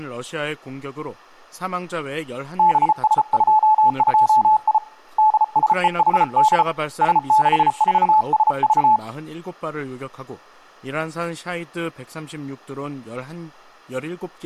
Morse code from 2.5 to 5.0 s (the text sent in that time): BS22I